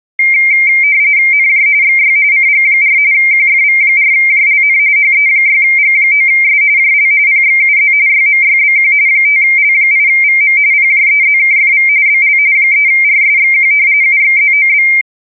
RTTY (45.45 baud, 170 Hz shift), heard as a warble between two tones, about 2200 Hz centre. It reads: NJ XY CG4 QFV4JLN HE6G9S JL PXUZ YMYBQ 5L8VM PJEZKFV BL 3RSXQ UXZOB